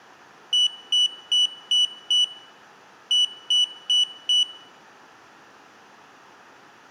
Beep code, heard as a piezo beeper, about 2950 Hz. 5-4.